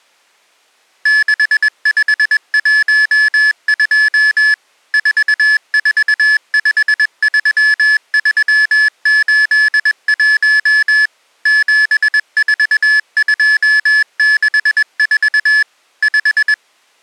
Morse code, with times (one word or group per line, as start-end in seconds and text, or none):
1.1-4.5 6512
4.9-11.1 4453381
11.5-15.6 74264
16.0-16.5 5